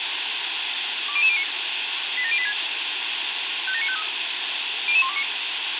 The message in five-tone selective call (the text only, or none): 20009 87086 57953 00129